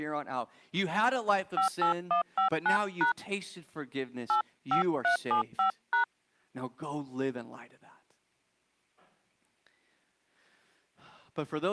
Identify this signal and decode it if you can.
DTMF, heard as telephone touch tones, dialled by hand, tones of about 110 ms, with speech in English. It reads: 58159# 85375#